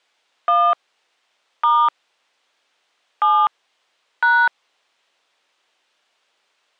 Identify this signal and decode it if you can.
DTMF, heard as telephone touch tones, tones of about 250 ms. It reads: 1 * 7 #